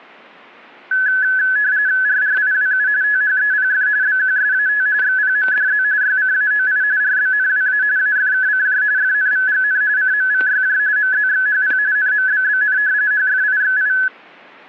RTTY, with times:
2.1-2.9 RRIWU
3.0-3.9 THEPF
4.0-4.9 BQSAT
5.0-5.8 XPMDZ
6.0-6.8 YCAOI
7.0-7.8 RBNWA
8.0-8.8 AFKCJ
9.0-9.8 FNVGN
10.0-10.8 CMVYJ
11.0-11.8 MZXHP
12.0-12.8 NMBBN
13.1-13.9 HFIXI

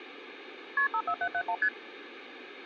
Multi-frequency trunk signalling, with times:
0.8-0.9 KP
0.9-1.5 54771
1.6-1.7 ST

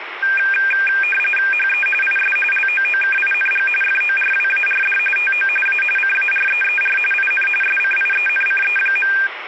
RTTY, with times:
1.5-1.9 HE
2.0-2.4 IS
2.5-3.7 LOOKING
3.8-5.0 FORWARD
5.2-5.5 TO
5.7-5.8 A
6.0-7.0 CAREER
7.1-7.5 IN
7.6-9.1 SCIENCE.

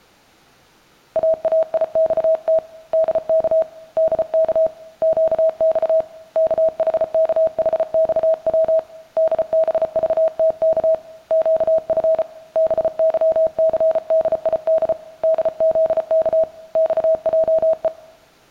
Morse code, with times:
1.2-2.6 AAIXT
2.9-3.6 DK
4.0-4.7 DK
5.0-6.0 QX
6.4-8.8 KHKHXW
9.2-10.9 DBVTK
11.3-12.2 QF
12.6-14.9 BYCDID
15.2-16.4 DZK
16.8-17.9 XJE

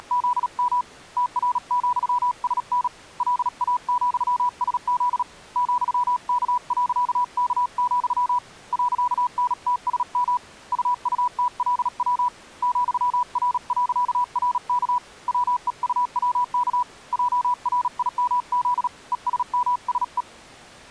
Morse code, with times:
0.0-0.8 …
1.2-2.9 TR,SN
3.2-5.2 LA,SZ
5.6-8.4 ,K.K,
8.7-10.4 .NTSM
10.7-12.3 UUTLW
12.6-15.0 ,R.RK
15.3-16.8 WEUWK
17.1-18.9 JRIMZ
19.1-20.2 ESMSE

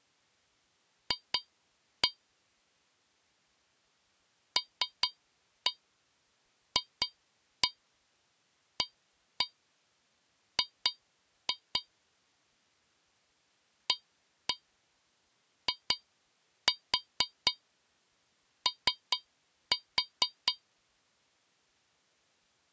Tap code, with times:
1.1-2.1 F
4.6-11.8 LFAG
13.9-20.5 AIO

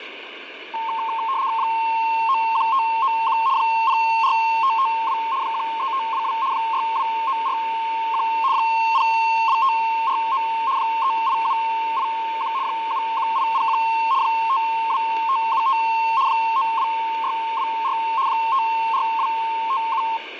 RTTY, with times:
1.6-3.4 91591
3.6-5.2 04552
5.4-6.3 13522
6.5-8.2 62941
8.5-10.4 02549
10.8-12.5 38781
12.6-13.8 71801
14.2-15.8 52575
16.3-17.9 92624
18.3-20.0 54257

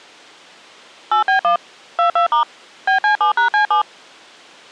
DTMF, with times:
1.1-1.6 8B1
2.0-2.4 22*
2.9-3.8 BC7#C7

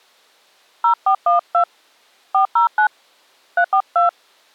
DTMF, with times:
0.8-1.6 0412
2.3-2.9 409
3.6-4.1 342

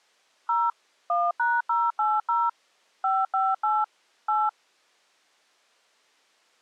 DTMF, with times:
0.5-0.7 0
1.1-2.5 1#080
3.0-3.8 558
4.3-4.5 8

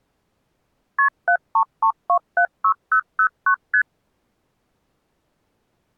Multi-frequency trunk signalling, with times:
1.0-1.1 KP
1.3-3.5 733276009
3.7-3.8 ST

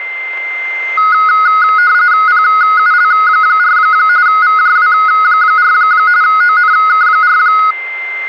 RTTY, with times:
2.3-3.8 PUL4
4.3-5.7 VJW4
6.2-7.4 ONK4

